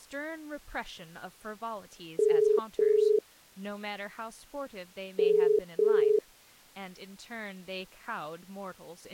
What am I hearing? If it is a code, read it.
Telephone call progress tone (as in the UK, Ireland, Australia and similar networks), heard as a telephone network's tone, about 430 Hz, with speech in English. Ringback tone.